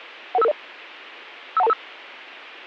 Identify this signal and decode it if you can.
Five-tone selective call (EIA), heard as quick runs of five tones, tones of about 30 ms. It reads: 11550 51225